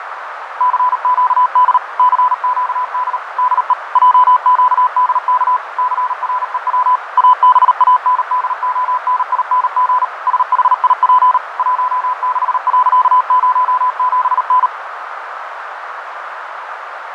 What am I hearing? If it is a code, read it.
Morse code, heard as a keyed tone, machine-sent, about 38 wpm, 1000 Hz, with radio static, fading and a narrow filter. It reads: CQD CQD DE JQDK CREW ABANDONING SHIP 16.07N